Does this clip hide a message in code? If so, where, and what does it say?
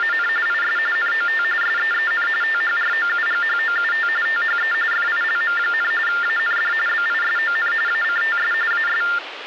Yes: TTY/TDD text telephone tones (45.45 baud Baudot) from 0.0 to 9.2 s, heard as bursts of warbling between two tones, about 400 Hz shift, 1600 Hz centre, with phone line noise. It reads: … IS NOT SEEN THROUGHOUT THE FILM, AND BISON ACTS AS